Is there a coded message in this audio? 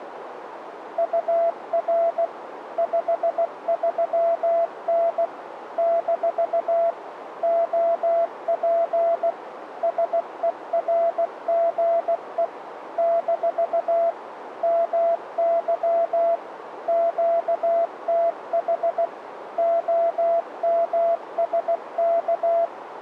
Yes: Morse code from 0.9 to 22.7 s, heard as a keyed tone, machine-sent, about 16 wpm, 670 Hz, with radio static and a narrow filter. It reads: UR 53N - OP SERGE - MY QTH OMSK